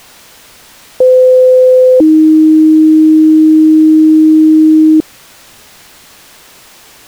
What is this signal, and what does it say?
Two-tone page, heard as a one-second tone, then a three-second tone, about 510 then 310 Hz.